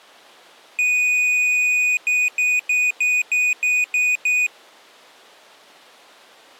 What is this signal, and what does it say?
Beep code, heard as a piezo beeper, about 2500 Hz. 1 long, 8 short. In AMI BIOS tables: display or retrace test failure.